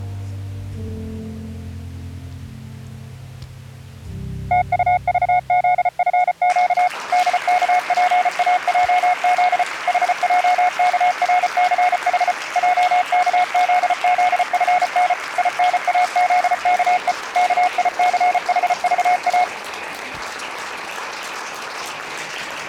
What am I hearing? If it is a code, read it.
Morse code, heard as a keyed tone, machine-sent, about 34 wpm, 720 Hz. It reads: TUVZFQ DKPAJZ HJKRCH JKZZFN INAZKE KICHVA